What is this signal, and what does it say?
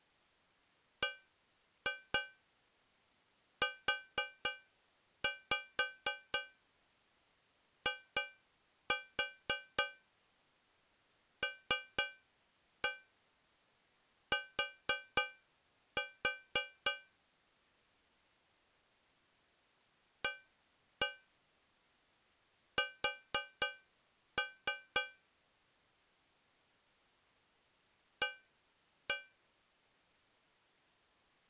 Tap code, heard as taps on a metal pipe, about 4 knocks a second. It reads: BUILT AS A